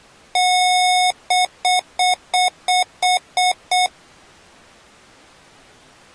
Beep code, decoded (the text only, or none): 1 long, 8 short